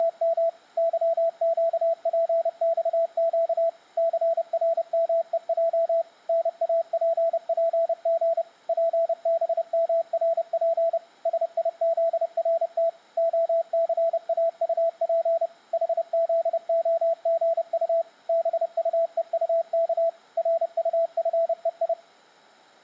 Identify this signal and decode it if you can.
Morse code, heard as a keyed tone, machine-sent, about 30 wpm, 660 Hz. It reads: … YQPXQ CRMEJ NAPPG PBMRP SIZRT OCAUP HZOGU BUEUK RUFEI